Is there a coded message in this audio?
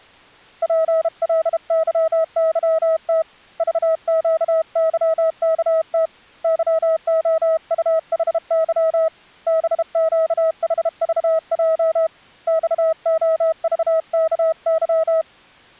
Yes: Morse code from 0.6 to 15.3 s, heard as a keyed tone, hand-sent with a bug key, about 32 wpm, 640 Hz. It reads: PLYYT VQYKT YOUHY BQHVJ XOVKY